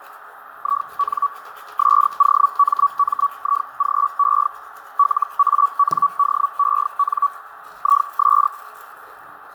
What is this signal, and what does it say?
Hellschreiber (Feld-Hell, 122.5 baud), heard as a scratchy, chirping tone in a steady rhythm, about 1140 Hz, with radio static, fading, a narrow filter and the noise of a restroom. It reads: IN SOMMIGE LANDEN IS